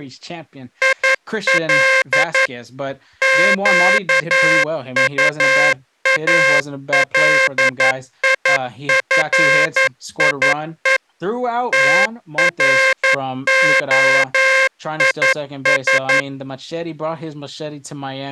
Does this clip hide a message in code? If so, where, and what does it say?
Yes: Morse code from 0.8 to 16.3 s, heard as a buzzer, machine-sent, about 11 wpm, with speech in English. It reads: IL QUALIFIE TROIS